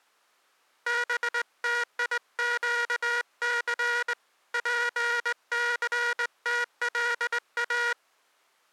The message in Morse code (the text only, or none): BTIQC PCTLA